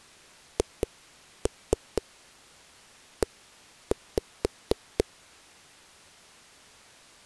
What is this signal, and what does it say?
Tap code, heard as knocks on a wall, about 4 knocks a second. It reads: HE